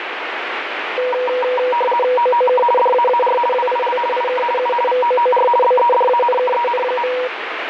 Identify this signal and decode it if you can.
RTTY (50 baud, 450 Hz shift), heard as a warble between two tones, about 730 Hz centre, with radio static. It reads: OOK DAAR WIL IK U VOOR BEDANKEN.